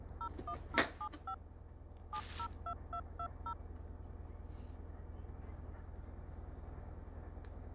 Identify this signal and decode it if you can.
DTMF, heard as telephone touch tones, dialled by machine, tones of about 70 ms, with kitchen noise. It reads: 01075 702220